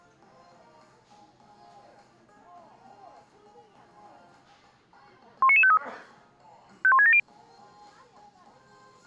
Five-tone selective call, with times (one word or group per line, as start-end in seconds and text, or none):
5.4-5.8 19953
6.8-7.2 51670